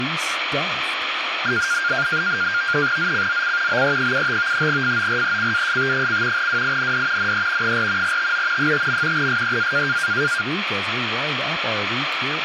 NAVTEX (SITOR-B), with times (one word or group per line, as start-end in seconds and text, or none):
3.0-3.8 ZCZC
3.7-4.7 BE75
4.7-6.5 FORECAST:
6.4-7.3 WIND
7.2-7.8 NE
7.6-8.2 4
8.0-8.7 TO
8.6-9.3 5.
9.2-10.0 SEA